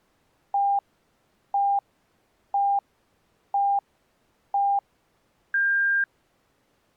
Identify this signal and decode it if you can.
Radio time signal (five pips and a higher one, as on Chinese radio), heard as pips.